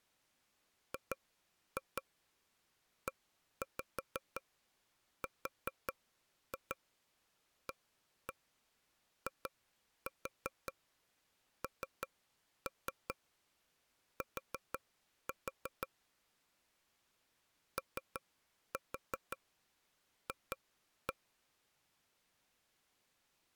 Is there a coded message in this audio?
Yes: tap code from 0.9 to 21.1 s, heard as taps on a table, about 5 knocks a second. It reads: GERAINT OF